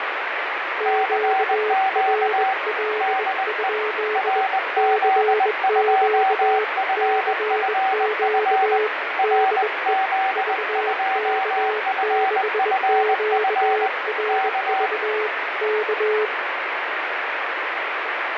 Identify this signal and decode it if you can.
Morse code, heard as two keyed tones, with radio static. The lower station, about 21 wpm, 430 Hz: QRL? CQ CQ DE VK6QRV K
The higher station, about 20 wpm, 770 Hz: CQ DE RZ2FFF RZ2FFF K